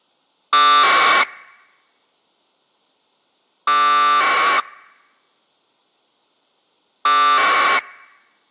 Packet radio (AX.25, as in APRS), 1200 baud, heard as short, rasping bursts.